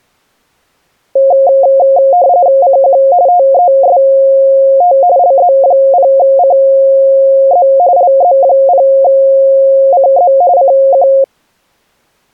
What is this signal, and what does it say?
RTTY (45.45 baud, 170 Hz shift), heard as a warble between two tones, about 630 Hz centre. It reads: CQ TEST LZ0CZ LZ0CZ CQ